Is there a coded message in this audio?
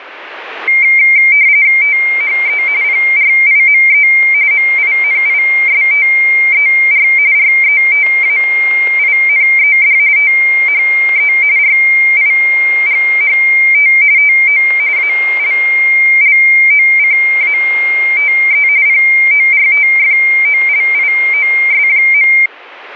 Yes: RTTY (45.45 baud, 170 Hz shift) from 0.7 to 22.5 s, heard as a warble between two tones, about 2200 Hz centre, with radio static and static crashes. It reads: THE PRIME MINISTER RETAINED THE RIGHT TO ALLOCATE PORTFOLIOS.